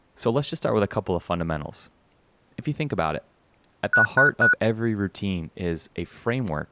Beep code, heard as beeps from a small speaker, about 1470 Hz, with speech in English. 3 short. In AMI BIOS tables: failure in the first 64 KB of memory; in Dell tables: chipset error.